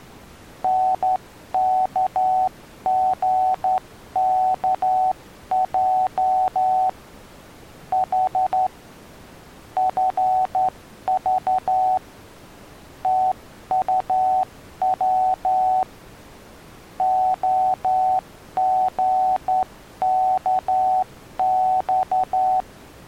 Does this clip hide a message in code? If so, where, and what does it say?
Yes: Morse code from 0.6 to 22.7 s, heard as a keyed tone, hand-sent with a straight key, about 11 wpm, 750 Hz. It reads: NKGKJ H FV TUW OGKX